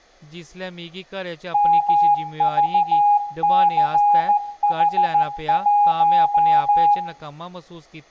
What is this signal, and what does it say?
Morse code, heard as a keyed tone, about 14 wpm, 820 Hz, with room echo and speech in Dogri. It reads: MVCH1